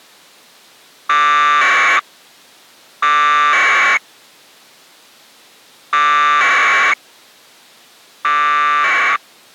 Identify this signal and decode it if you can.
Packet radio (AX.25, as in APRS), 1200 baud, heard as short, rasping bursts.